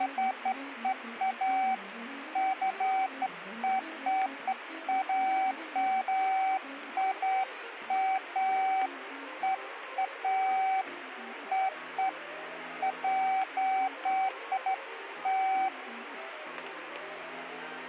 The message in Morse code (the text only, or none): none